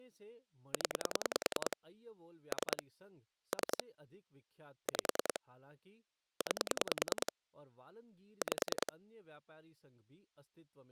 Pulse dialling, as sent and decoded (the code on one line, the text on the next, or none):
10 / 3 / 3 / 5 / 9 / 5
0 3 3 5 9 5